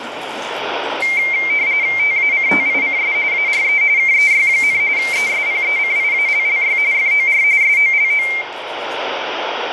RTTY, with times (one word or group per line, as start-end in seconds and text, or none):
2.0-3.1 TACTICS
3.3-3.8 ARE
4.0-4.8 KEY,
5.0-6.8 ESPECIALLY
6.9-7.4 FOR
7.6-8.3 SOLO